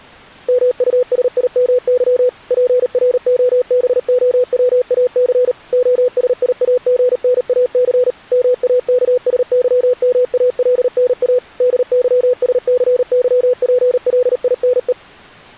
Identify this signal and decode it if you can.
Morse code, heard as a keyed tone, machine-sent, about 38 wpm, 500 Hz. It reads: MUSIMY PROBOWAC OSIAGNAC MAKSYMALNA DYSCYPLINE